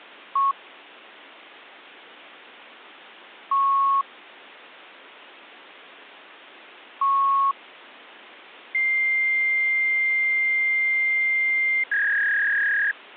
Fax machine handshake, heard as beeps, a long tone and a warble, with phone line noise.